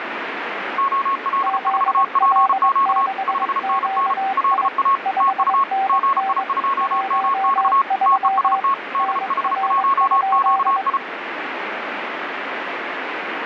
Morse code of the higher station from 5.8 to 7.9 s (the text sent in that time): GI2MX